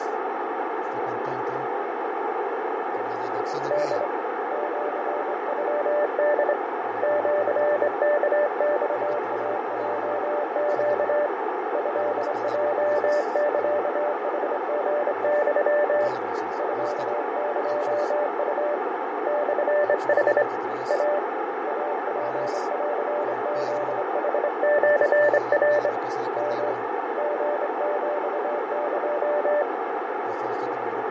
Morse code (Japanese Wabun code), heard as a keyed tone, hand-sent with a straight key, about 25 wpm, 590 Hz, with heavy radio static, fading and a narrow filter. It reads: ホ シノホ シワマイヲネ トヲサヌリユ ミエウ モヌ イ イツンフヌシナ ヨ リヒエ